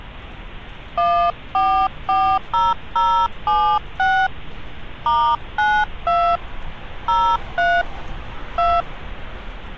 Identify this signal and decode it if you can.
DTMF, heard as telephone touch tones, dialled by hand, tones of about 260 ms, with street noise. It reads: 1440076 *92 03 2